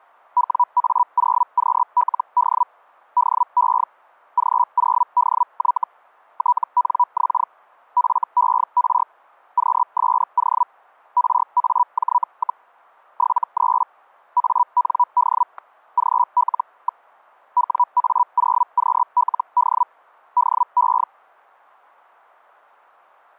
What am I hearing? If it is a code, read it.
Hellschreiber (Feld-Hell, 122.5 baud), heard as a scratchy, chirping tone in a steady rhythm, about 980 Hz, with static crashes. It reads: WA0QLD DE G0DY TNX FER QSO RAJ, 73 AND GL. WA0QLD DE